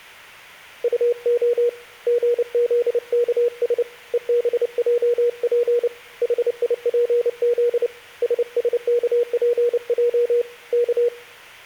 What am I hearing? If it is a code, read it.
Morse code, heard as a keyed tone, hand-sent with a paddle, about 29 wpm, 480 Hz. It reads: UO GZKS EBJP HIPZ SSKPJ K